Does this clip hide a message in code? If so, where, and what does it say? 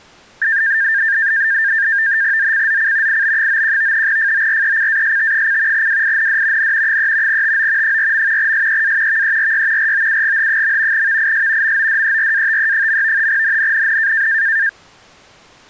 Yes: NAVTEX (SITOR-B), 100 baud, 170 Hz shift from 0.4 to 14.7 s, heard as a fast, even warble, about 1700 Hz centre. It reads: ZCZC IB91 FORECAST: WIND N 3 TO 4. SEA VERY ROUGH. VIS MODERATE. NNNN